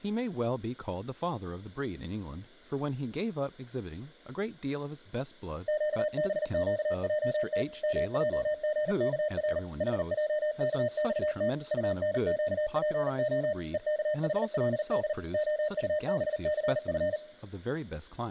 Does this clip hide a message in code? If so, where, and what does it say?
Yes: Morse code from 5.6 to 17.2 s, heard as a keyed tone, machine-sent, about 39 wpm, 610 Hz, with speech in English. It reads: QBQJT MJGKR HJKXT UNQPO EKHLD OUBCF